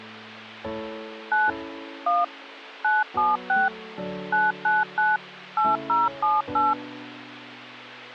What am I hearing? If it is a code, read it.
DTMF, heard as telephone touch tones, dialled by machine, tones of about 180 ms. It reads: 9 1 976 999 8078